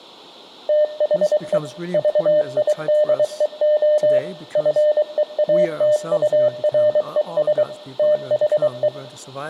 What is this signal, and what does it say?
Morse code, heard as a keyed tone, machine-sent, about 23 wpm, 600 Hz, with room echo and speech in English. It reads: THE VIDEO FEATURES THE